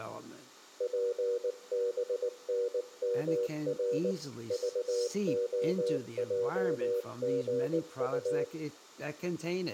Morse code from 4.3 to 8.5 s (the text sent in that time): VOJGU